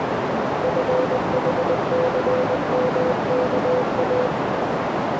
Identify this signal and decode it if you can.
Morse code (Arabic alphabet), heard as a keyed tone, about 20 wpm, 510 Hz, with heavy radio static and a narrow filter. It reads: فحثمكا